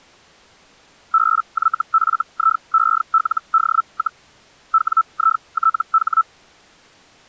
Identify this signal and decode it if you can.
Hellschreiber (Feld-Hell, 122.5 baud), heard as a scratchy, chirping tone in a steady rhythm, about 1320 Hz. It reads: BYFIELD, WITH